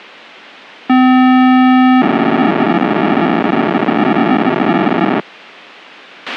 POCSAG pager data (512 baud), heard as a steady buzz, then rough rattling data, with a squelch burst at the end.